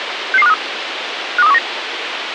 Five-tone selective call (EEA), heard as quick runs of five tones, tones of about 40 ms, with radio hiss. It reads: 66253 52319